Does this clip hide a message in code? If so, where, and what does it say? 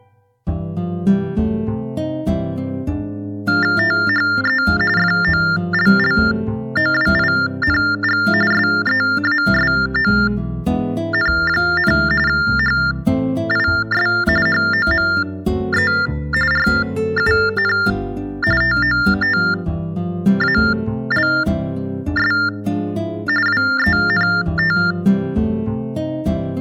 Yes: TTY/TDD text telephone tones (45.45 baud Baudot) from 3.5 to 24.9 s, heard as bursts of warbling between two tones, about 400 Hz shift, 1600 Hz centre. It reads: THE FOLLOWING SEASON, HIS HOME RUN TOTALS WENT